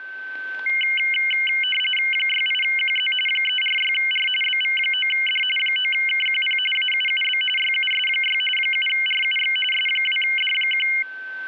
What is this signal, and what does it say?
RTTY (45.45 baud, 850 Hz shift), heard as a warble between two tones, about 2550 Hz centre, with a steady whistle near 1540 Hz. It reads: 68QZ 346R BV9D 9KQP AUUB YUS6 7RUX S2D1